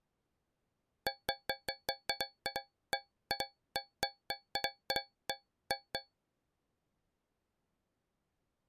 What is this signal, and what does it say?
Irregular taps on a metal pipe. There is no code.